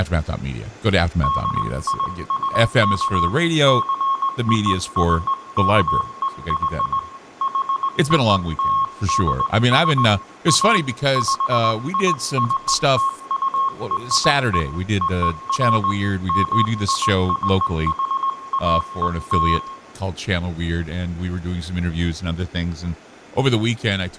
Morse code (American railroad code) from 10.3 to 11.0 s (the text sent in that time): A